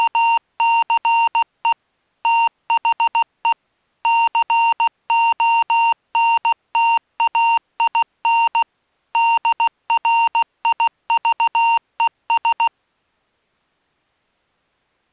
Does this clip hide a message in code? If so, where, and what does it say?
Yes: Morse code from 0.0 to 12.7 s, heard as electronic beeps, machine-sent, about 16 wpm, 920 Hz. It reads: … THE CONTAIN DRIVES